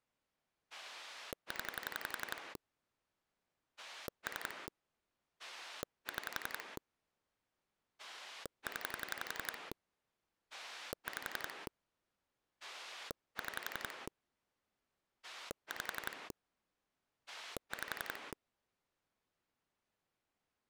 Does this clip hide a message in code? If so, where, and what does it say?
Yes: pulse dialling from 0.7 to 18.3 s, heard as a rotary dial, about 11 pulses a second. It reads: 0 3 6 0 5 6 5 5